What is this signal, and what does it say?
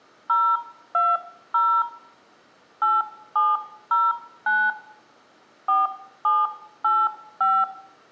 DTMF, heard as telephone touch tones, dialled by hand, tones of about 230 ms, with room echo. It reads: 020 8709 4785